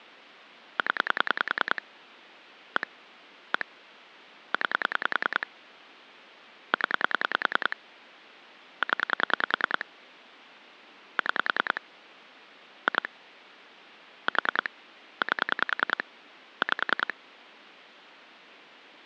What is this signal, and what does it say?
Pulse dialling, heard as clicks on a phone line, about 10 pulses a second. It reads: 0 1 1 9 0 0 6 2 4 8 5